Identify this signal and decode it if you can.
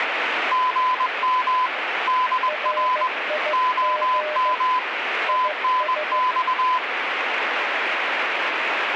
Morse code, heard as two keyed tones, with radio static. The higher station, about 21 wpm, 1010 Hz: GM DR OM TNX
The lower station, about 15 wpm, 610 Hz: RIG IS